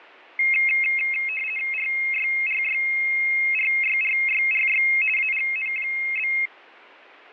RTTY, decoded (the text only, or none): RYRYRYRYRY AGN?